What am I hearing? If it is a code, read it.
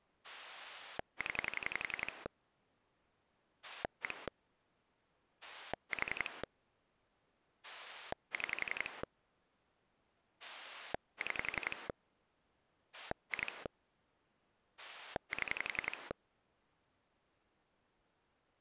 Pulse dialling, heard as a rotary dial, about 11 pulses a second. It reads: 0 1 4 6 6 2 7